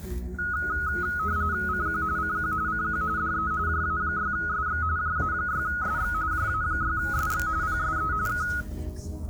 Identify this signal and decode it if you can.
RTTY (45.45 baud, 170 Hz shift), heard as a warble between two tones, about 1360 Hz centre, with the noise inside a car. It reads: CQ CQ CQ DE JA6SX JA6SX JA6SX PSE K